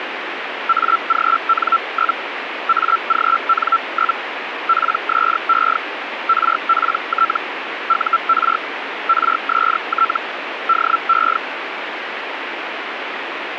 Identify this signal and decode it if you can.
Hellschreiber (Feld-Hell, 122.5 baud), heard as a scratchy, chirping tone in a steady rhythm, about 1340 Hz, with radio static. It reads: AGN? AGN? PSE RPT UR RST DE